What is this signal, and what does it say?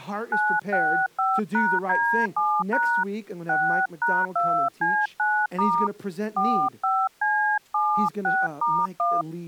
DTMF, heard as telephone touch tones, dialled by hand, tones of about 290 ms, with speech in English. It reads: 965#D7# 6#2C9* 45C76*1